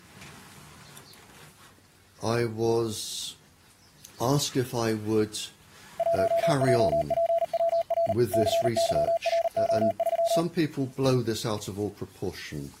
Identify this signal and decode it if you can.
Morse code, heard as a keyed tone, machine-sent, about 39 wpm, 670 Hz. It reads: 1JPWR CYRO3